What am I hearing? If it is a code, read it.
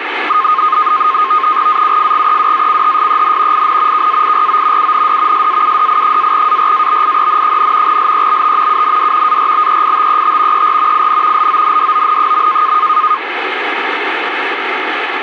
NAVTEX (SITOR-B), 100 baud, 170 Hz shift, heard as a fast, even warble, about 1150 Hz centre, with radio static. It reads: AUFGEWACHSEN IN KAIRO UND SAUDI-ARABIEN, LEBT UND ARBEITET ER IN LONDON.